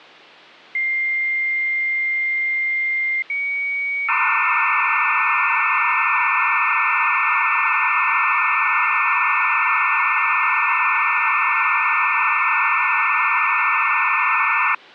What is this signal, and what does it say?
Dial-up modem handshake (low-speed, two carriers), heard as two whistles, then hiss.